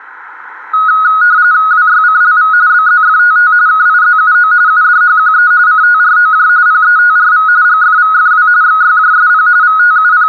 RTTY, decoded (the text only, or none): WYCLV BZFTT KIZUO UDHQE CTROJ PETRV GFVFW XYJSP …